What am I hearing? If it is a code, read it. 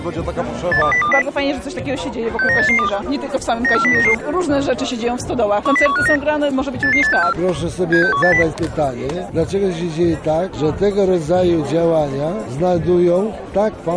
Five-tone selective call (CCIR), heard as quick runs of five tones, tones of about 100 ms. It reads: 82020 69882 94099 10159 88864 76180